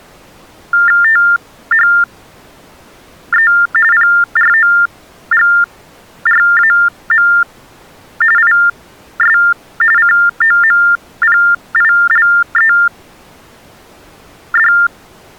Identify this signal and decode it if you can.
TTY/TDD text telephone tones (45.45 baud Baudot), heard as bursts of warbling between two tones, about 400 Hz shift, 1600 Hz centre. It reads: THE PROGRAM IS COMPILED